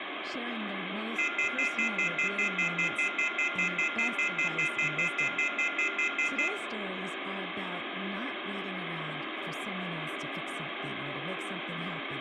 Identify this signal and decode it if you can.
Telephone call progress tone (North American plan), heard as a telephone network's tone, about 1400, 2050, 2450, 2600 Hz, 0.1 s on and 0.1 s off, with phone line noise, room echo and speech in English. Off-hook warning tone.